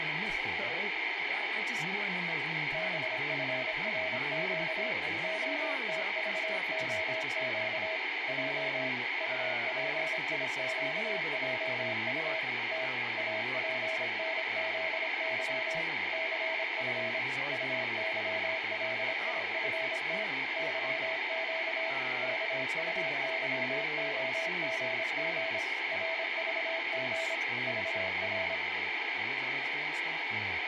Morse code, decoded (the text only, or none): BFRQ OTVOQ J UPIQJU T APNZY CF UYLIFT YQ KUYOGG RVG VR